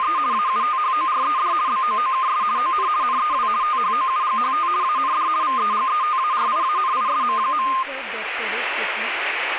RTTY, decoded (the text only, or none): … AUTHORED BOOKS ON NEW THOUGHT AND VEGETARIANISM.